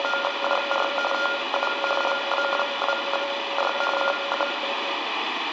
RTTY (45.45 baud, 850 Hz shift), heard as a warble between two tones, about 980 Hz centre, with radio static and room echo. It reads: … TU LA2Y CQ